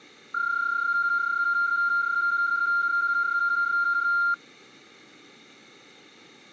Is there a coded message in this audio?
Yes: PSK31 (31.25 baud) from 0.3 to 4.3 s, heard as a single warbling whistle, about 1400 Hz.